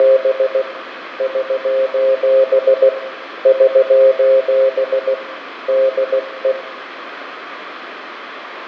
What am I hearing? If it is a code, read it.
Morse code, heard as a keyed tone, hand-sent with a paddle, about 16 wpm, 530 Hz, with radio static, fading and room echo. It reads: … <SOS> <SOS> DE